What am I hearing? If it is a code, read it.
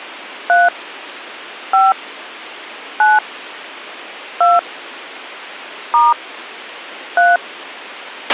DTMF, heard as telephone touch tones, dialled by hand, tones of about 190 ms, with a squelch burst at the end. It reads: 3 5 9 2 * 3